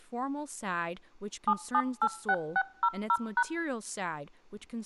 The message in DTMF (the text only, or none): 7786600#